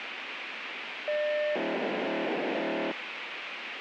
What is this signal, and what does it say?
POCSAG pager data (1200 baud), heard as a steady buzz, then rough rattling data, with radio hiss.